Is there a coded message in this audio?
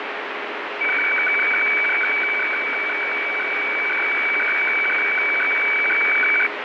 Yes: weather fax (radiofax), 120 lines a minute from 0.8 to 6.5 s, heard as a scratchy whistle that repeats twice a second, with heavy radio static.